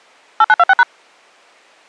DTMF, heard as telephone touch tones, dialled by machine, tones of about 40 ms. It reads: 8926#